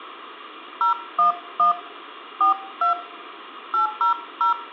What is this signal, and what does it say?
DTMF, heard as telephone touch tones, dialled by hand, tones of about 120 ms, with room echo. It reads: 011 42 800